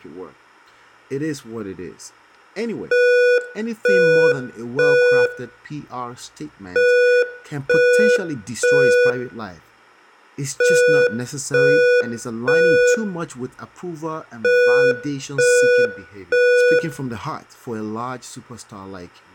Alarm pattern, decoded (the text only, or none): temporal three